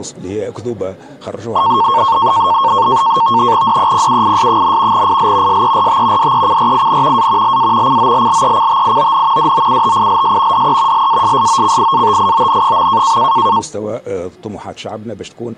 NAVTEX (SITOR-B), 100 baud, 170 Hz shift, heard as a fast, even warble, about 1000 Hz centre. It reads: DEPUIS, IL SERT DECRIN A LA COLLECTION DOUTILS DE LASSOCIATION.